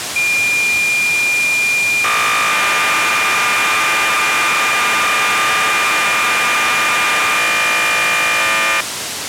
Cassette data (Kansas City type), 1200 baud, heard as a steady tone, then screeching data, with tape hiss.